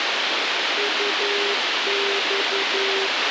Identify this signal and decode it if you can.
Morse code, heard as a keyed tone, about 11 wpm, 400 Hz, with radio hiss and a squelch burst at the end. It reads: UX